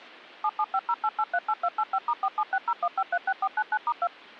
DTMF, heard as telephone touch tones, dialled by machine, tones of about 60 ms. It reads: 77508838285*47601536499*2